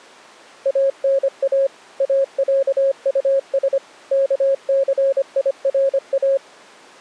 Morse code (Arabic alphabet), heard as a keyed tone, machine-sent, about 25 wpm, 540 Hz. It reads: انا اعطس كثيرا